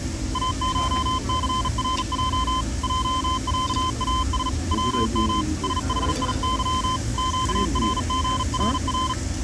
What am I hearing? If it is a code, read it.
Morse code (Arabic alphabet), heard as a keyed tone, hand-sent with a bug key, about 38 wpm, 1030 Hz, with the noise of a crowd indoors. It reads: اشثرج جعاس وم سحيظ قرغرر